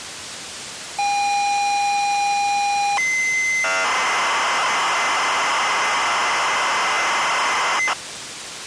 ZX Spectrum tape loading, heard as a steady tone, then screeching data, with tape hiss.